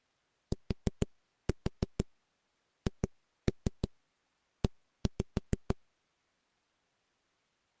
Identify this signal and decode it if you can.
Tap code, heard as knocks on a wall, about 6 knocks a second. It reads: THE